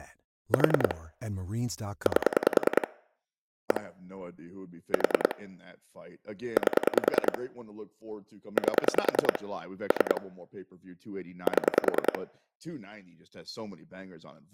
Pulse dialling, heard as clicks on a phone line, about 10 pulses a second, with speech in English. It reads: 4 8 1 4 8 8 3 7